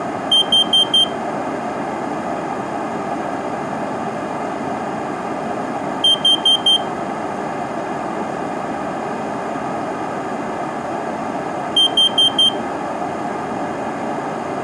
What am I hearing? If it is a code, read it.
Alarm pattern, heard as an alarm's beeps, played three times, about 3150 Hz. Temporal four. Carbon monoxide.